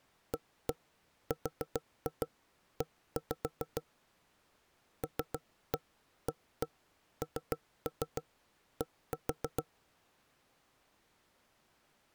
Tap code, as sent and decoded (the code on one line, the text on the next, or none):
1-1 4-2 1-5 / 3-1 1-1 3-3 1-4
ARE LAND